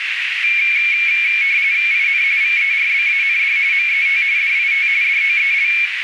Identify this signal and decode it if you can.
RTTY (45.45 baud, 170 Hz shift), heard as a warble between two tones, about 2300 Hz centre, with radio static and a narrow filter. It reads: IN VERBAND MET DIT DOEL